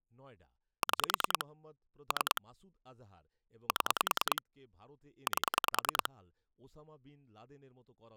Pulse dialling, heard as clicks on a phone line, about 10 pulses a second, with speech in Bangla. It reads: 6 3 7 8